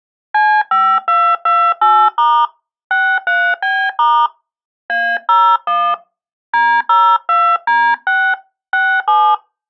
DTMF, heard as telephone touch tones, dialled by hand, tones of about 270 ms. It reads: C5228* 63B* A01 D02D6 67